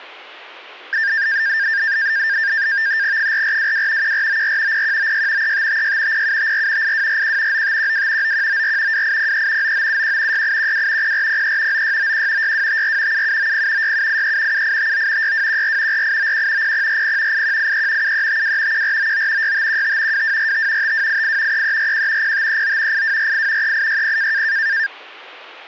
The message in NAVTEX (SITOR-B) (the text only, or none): 4422 1494 0196 3556 0754 8241 9512 9194 2803 9971 6812 0403 9691 6254 7790 6783 7859 6214 4891 0040 8183 7352 1499 6515 2245 5288 3341 0539 8248 3860